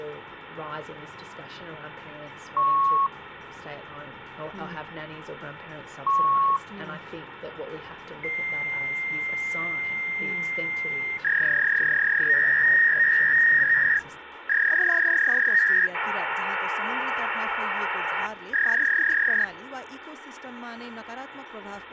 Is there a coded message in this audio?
Yes: fax machine handshake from 2.6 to 19.4 s, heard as beeps, a long tone, a warble and hiss, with phone line noise.